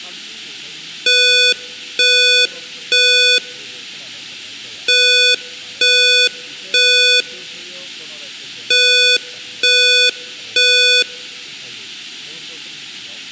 Alarm pattern, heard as an alarm's beeps, played three times, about 500 Hz, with room echo and speech in Bodo. Temporal three. Smoke or fire, evacuate.